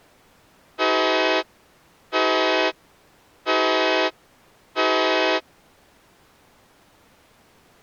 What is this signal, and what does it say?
Train horn signal, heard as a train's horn. 4 short. On North American railways: a request for a signal to be given or repeated.